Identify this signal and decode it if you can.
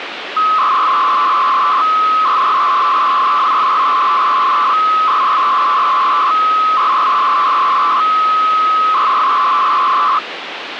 300-baud modem data (Bell 103 tones), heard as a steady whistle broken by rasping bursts, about 300 baud, 200 Hz shift, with phone line noise.